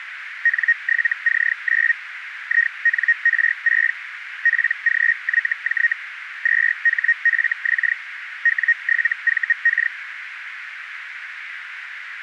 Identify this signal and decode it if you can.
Hellschreiber (Feld-Hell, 122.5 baud), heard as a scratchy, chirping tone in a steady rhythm, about 1850 Hz, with radio static and a narrow filter. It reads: N7C9 INR6 PGYJ 2HFX W7VK